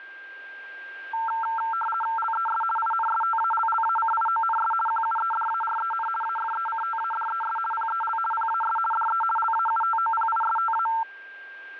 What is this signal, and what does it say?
RTTY (50 baud, 450 Hz shift), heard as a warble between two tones, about 1120 Hz centre, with a steady whistle near 1590 Hz. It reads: LES INSTALLACIONS QUEDAREN AFECTADES PEL PAS DE LAUTOPISTA